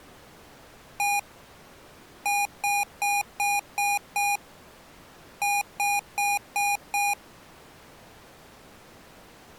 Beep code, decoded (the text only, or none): 1-6-5